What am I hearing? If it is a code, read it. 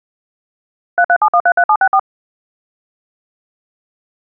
DTMF, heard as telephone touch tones, dialled by machine, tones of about 70 ms. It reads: 337133764